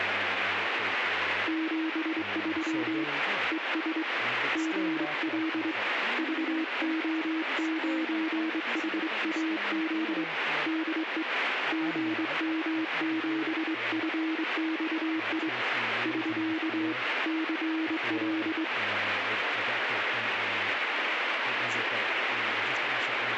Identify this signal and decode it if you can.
Morse code, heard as a keyed tone, hand-sent with a straight key, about 24 wpm, 320 Hz, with radio static and speech in English. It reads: 73 ES GL VO9HAZ DE GM7FXI <SK> CL